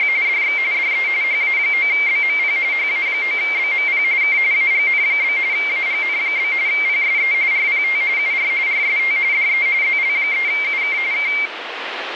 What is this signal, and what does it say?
RTTY (45.45 baud, 170 Hz shift), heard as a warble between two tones, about 2200 Hz centre, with radio static. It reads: … DX DE HA9BMP HA9BMP K AGN? AGN? PSE RPT UR RST DE ZL3UK K